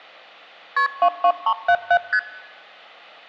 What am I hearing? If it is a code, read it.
Multi-frequency trunk signalling (R1, as on North American trunks), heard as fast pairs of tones, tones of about 70 ms. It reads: KP 22377 ST